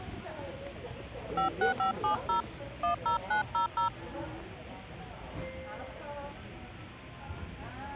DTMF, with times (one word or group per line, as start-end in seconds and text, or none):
1.4-2.4 56570
2.8-3.9 10900